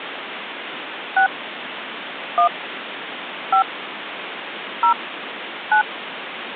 DTMF, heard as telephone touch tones, dialled by hand, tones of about 100 ms, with phone line noise. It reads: 6 1 5 0 9